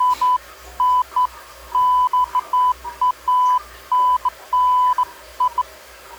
Beeps of irregular length, with the noise of a restroom. There is no code.